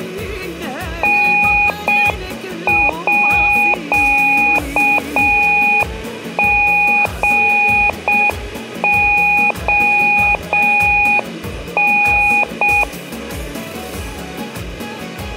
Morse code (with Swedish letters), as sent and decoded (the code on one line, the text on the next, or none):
-. .--.- --. --- -.
NÅGON